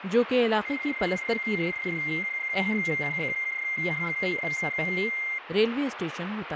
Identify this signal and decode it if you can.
PSK31 (31.25 baud), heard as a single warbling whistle, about 2100 Hz, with radio static and speech in Urdu.